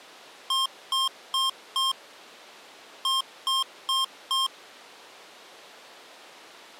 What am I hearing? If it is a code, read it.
Beep code, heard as beeps from a small speaker, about 1060 Hz. 4-4.